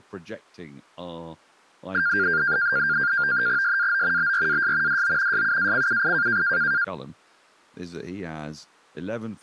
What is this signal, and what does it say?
NAVTEX (SITOR-B), 100 baud, 170 Hz shift, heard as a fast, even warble, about 1500 Hz centre, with speech in English. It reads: SAO BRAS DO SUACUI